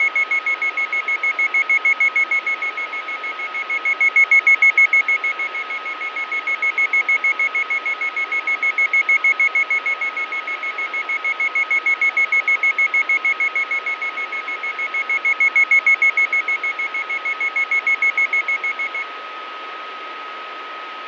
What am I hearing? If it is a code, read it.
Evenly repeated beeps, with radio static, fading and a steady whistle near 1270 Hz. There is no code.